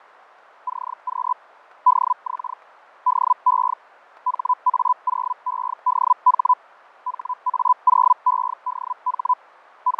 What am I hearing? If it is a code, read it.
Hellschreiber (Feld-Hell, 122.5 baud), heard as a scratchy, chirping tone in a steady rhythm, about 1000 Hz, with radio static and fading. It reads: CQ DX DE HA0EDH HA0EDH …